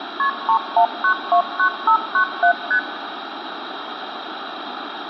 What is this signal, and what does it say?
Multi-frequency trunk signalling (R1, as on North American trunks), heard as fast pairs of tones, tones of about 90 ms, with phone line noise. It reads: KP 31929597 ST